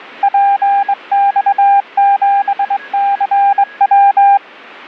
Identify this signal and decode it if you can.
Morse code, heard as a keyed tone, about 22 wpm, 800 Hz, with a weaker station near 1660 Hz. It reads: PX7CW